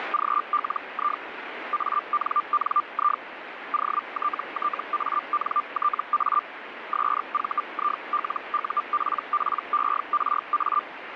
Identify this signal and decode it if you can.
Hellschreiber (Feld-Hell, 122.5 baud), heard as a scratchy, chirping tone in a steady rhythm, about 1190 Hz, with radio static. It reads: … ANNI OTTANTA SVILUPPERA